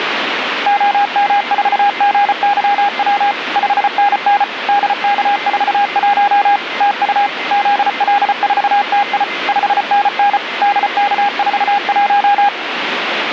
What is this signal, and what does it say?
Morse code, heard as a keyed tone, machine-sent, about 34 wpm, 810 Hz, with radio static and a weaker station near 2070 Hz. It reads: OM4GYW 5NN DK41 TU ZL4TI 5NN DK41